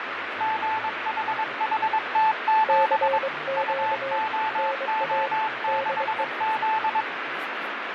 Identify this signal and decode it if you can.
Morse code, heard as two keyed tones, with radio static, fading and speech in Urdu. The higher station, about 22 wpm, 880 Hz: GHHT7 UOO6Z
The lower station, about 23 wpm, 540 Hz: CQ NA DE